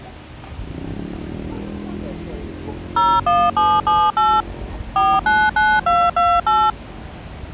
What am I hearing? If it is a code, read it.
DTMF, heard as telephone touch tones, dialled by machine, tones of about 240 ms, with street noise. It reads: 01778 499228